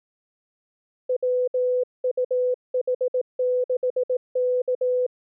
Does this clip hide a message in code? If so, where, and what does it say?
Yes: Morse code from 1.0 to 5.1 s, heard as a keyed tone, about 18 wpm, 500 Hz. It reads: WUH6K